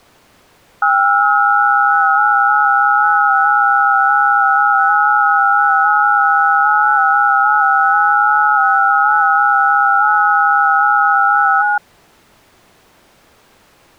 FT8 (several signals at once), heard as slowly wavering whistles, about 6.25 baud.